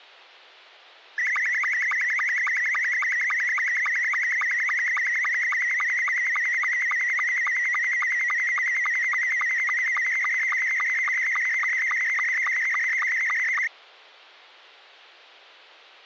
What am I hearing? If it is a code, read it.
SSTV (slow-scan television), Scottie S2, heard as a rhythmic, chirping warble.